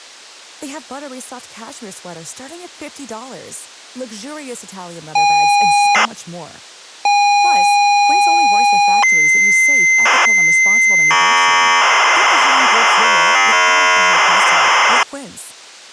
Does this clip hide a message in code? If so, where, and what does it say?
Yes: ZX Spectrum tape loading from 5.2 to 15.0 s, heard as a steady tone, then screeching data, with speech in Swedish.